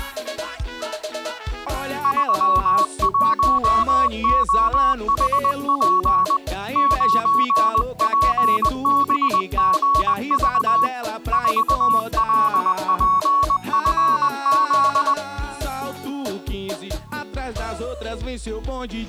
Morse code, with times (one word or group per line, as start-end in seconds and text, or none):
2.0-6.4 31OHP
6.8-10.9 9PBGV
11.3-15.1 4LPFZ